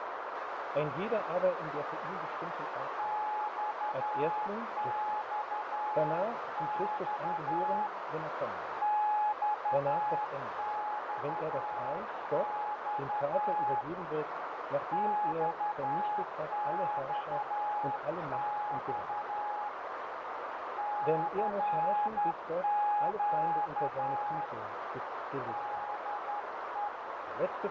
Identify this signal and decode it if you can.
Morse code, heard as a keyed tone, hand-sent with a straight key, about 11 wpm, 840 Hz, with heavy radio static and a narrow filter. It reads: XXX XXX XXX CQ DE